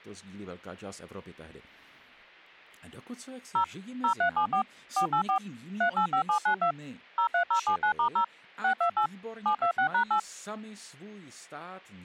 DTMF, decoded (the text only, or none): 0 0374 484 385792 03079*0 628 726#8